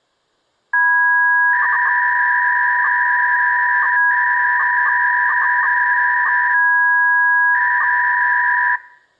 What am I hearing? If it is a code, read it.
300-baud modem data (V.21 tones), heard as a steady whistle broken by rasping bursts, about 300 baud, 200 Hz shift.